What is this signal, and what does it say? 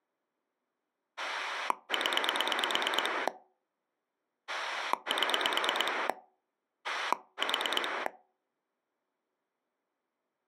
Pulse dialling, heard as a rotary dial, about 9 pulses a second. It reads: 0 7 4